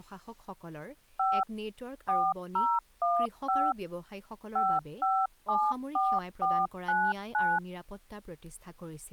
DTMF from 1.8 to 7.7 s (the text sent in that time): 4015 5574499